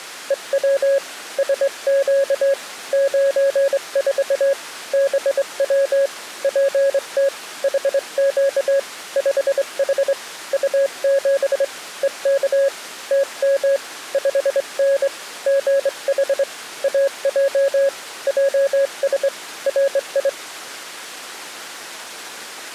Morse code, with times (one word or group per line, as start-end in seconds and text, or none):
0.3-1.0 EW
1.4-2.5 SQ
2.9-4.5 94
4.9-6.1 BW
6.4-7.3 PT
7.6-8.8 HQ
9.2-10.1 5H
10.5-11.6 U7
12.0-12.7 EK
13.1-13.8 TM
14.1-15.1 5N
15.5-16.4 GH
16.8-17.9 AJ
18.3-19.3 JS
19.7-20.3 RI